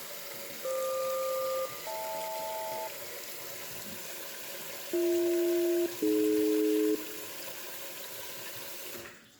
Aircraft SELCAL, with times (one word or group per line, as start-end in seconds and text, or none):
0.6-2.9 FQ-HL
4.9-7.0 BH-AD